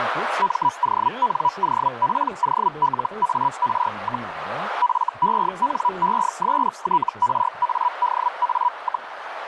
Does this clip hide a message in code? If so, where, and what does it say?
Yes: Hellschreiber (Feld-Hell, 122.5 baud) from 0.4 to 9.1 s, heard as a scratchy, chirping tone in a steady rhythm, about 980 Hz, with radio static, a narrow filter and speech in Russian. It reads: MONOPOLAR, FENESTRADA,